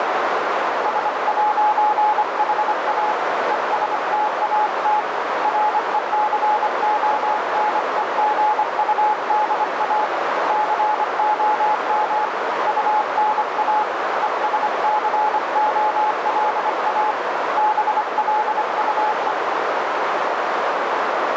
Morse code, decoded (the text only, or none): S'HA ESTAT RECONEGUDA COM UNA ESCOLA BLUE